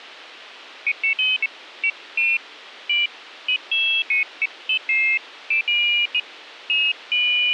Pairs of high tones at irregular times, with radio hiss. There is no code.